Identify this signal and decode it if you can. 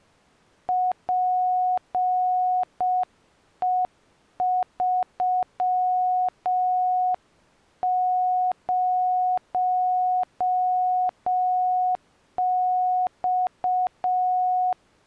Morse code, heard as a keyed tone, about 6 wpm, 730 Hz. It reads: PE30X